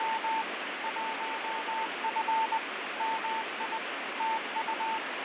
Morse code, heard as a keyed tone, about 20 wpm, 890 Hz, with heavy radio static and fading. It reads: … 1F MI TU